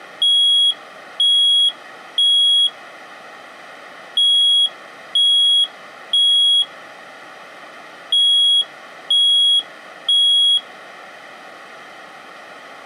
Alarm pattern, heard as an alarm's beeps, played three times, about 3300 Hz. Temporal three. Smoke or fire, evacuate.